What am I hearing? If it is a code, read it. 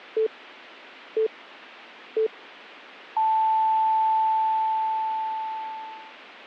Radio time signal (three low pips and a long one an octave up, as on NHK), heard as pips.